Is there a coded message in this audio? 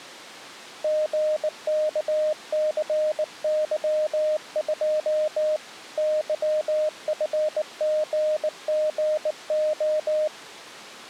Yes: Morse code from 0.8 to 10.3 s, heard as a keyed tone, hand-sent with a bug key, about 19 wpm, 620 Hz. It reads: GKCY2 YFGGO